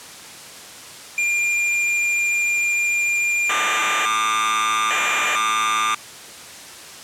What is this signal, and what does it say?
Cassette data (Kansas City type), 1200 baud, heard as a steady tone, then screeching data.